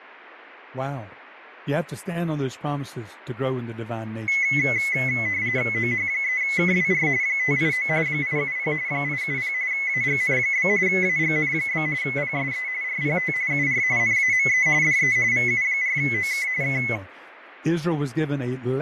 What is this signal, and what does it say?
RTTY (45.45 baud, 170 Hz shift), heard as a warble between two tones, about 2100 Hz centre, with radio static, fading and speech in English. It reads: OH3KWR 589 870 870 AGN? AGN? PSE RPT UR NAME DE VU4OK K